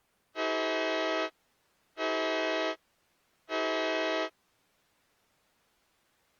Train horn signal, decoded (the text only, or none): 3 short